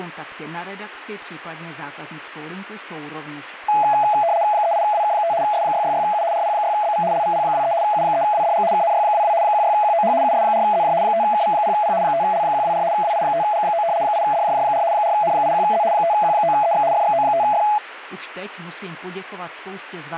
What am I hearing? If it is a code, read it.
RTTY (75 baud, 170 Hz shift), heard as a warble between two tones, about 760 Hz centre. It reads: 38WK5 S666U RP6BV LVP23 U3WDG KNY22 16QOH US4ZJ 5KV0P 5L124 WI5G9 8DJJ4 4N81Z 5Q9EX FXO5F